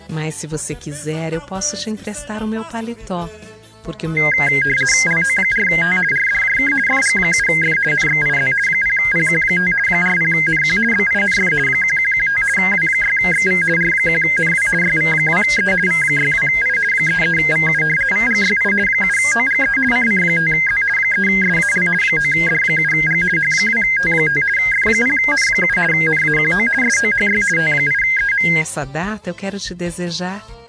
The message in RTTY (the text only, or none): LO4T RDJK FG7F NXIZ 0PQ5 40NQ BINF 1115 W6XV R1NW YV2E V62I 33VU VGYI 7OGE CC5Z 3SAL 9D7G H2T5 F0N7 NAQO SOHY T8EM